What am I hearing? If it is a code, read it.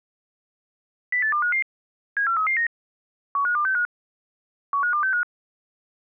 Five-tone selective call (CCIR), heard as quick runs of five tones, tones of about 100 ms. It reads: 08255 74339 15265 15265